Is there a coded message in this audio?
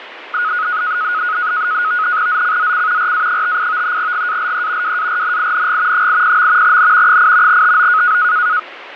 Yes: NAVTEX (SITOR-B), 100 baud, 170 Hz shift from 0.3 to 8.6 s, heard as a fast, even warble, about 1360 Hz centre, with radio static and fading. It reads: ZCZC RA58 GALE WARNING 80. N 8 TO